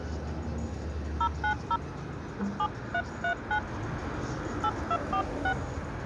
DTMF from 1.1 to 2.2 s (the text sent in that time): 090